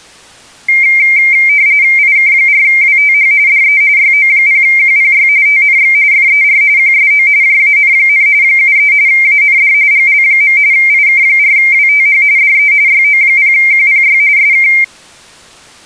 RTTY (45.45 baud, 170 Hz shift), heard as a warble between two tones, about 2200 Hz centre. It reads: IK4WTH DE YO0QPY TNX FER QSO JAN, 73 AND GL. IK4WTH DE YO0QPY SK